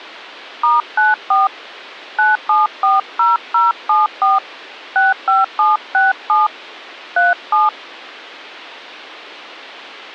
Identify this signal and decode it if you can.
DTMF, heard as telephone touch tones, dialled by hand, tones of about 170 ms. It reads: *94 9740074 65767 37